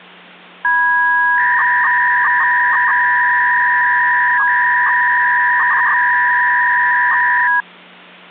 300-baud modem data (V.21 tones), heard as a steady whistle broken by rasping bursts, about 300 baud, 200 Hz shift, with hum.